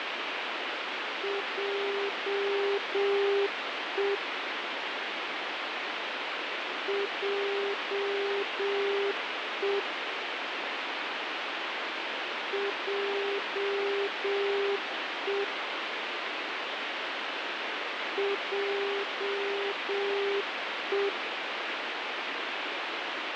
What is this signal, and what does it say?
Morse code, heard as a keyed tone, machine-sent, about 7 wpm, 400 Hz, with radio static. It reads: JE JE JE JE